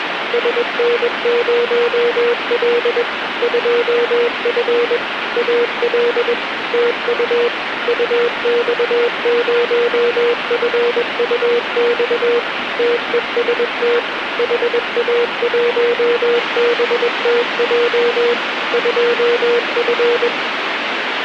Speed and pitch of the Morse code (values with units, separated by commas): 21 wpm, 480 Hz